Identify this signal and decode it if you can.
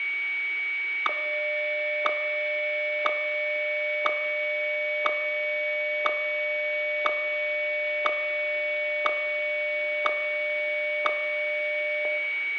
Radio time signal (WWVH, Hawaii), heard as ticks, one a second, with a steady whistle near 2250 Hz.